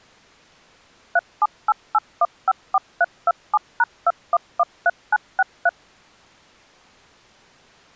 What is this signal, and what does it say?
DTMF, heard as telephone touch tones, dialled by machine, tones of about 40 ms. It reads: 3788154327#2113963